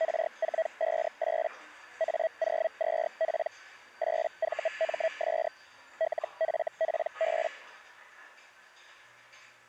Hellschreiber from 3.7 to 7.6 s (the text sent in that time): 8VMS LFPB